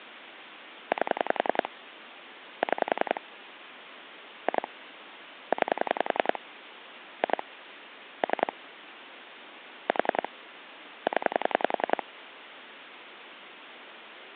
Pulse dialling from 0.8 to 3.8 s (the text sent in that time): 8 6